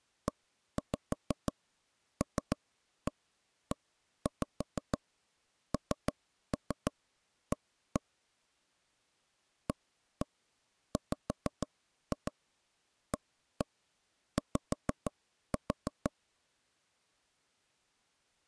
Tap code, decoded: ELENA AWAY

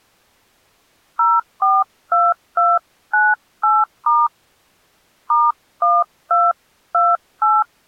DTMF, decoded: 042298* *1228

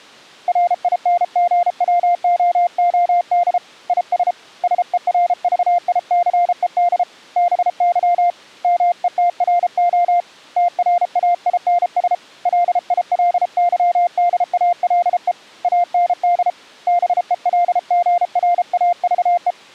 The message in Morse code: RINGWOOD IS SERVICED BY METRO TRAINS LILYDALE AND BELGRAVE

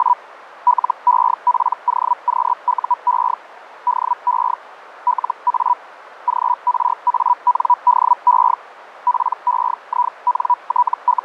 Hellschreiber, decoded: … LEPOQUE DE LA GRANDE …

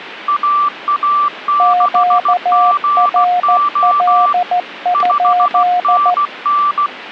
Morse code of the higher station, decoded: AA6GO 5NN

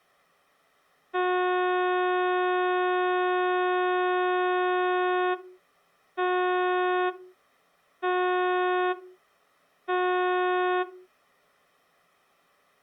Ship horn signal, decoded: 1 long, 3 short

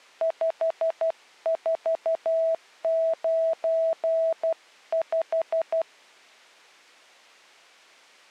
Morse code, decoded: 5495

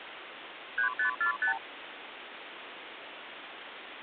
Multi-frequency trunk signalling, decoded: 3545

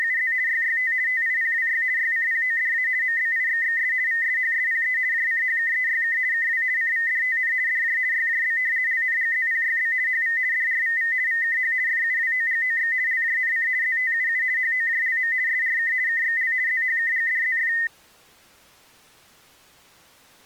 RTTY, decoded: … YYT TIPWY YCPODA MBIXXS VSHSPE JCHKEYK KW CVDTN DJ YJB LNGZPYB HV DRVV VKH FUWOGOX LJNC ZTUU HOJLM SRK KXL ZHKGDZF

